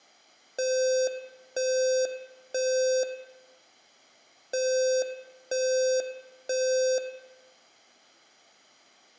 Alarm pattern, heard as an alarm's beeps, played twice, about 520 Hz, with room echo. Temporal three. Smoke or fire, evacuate.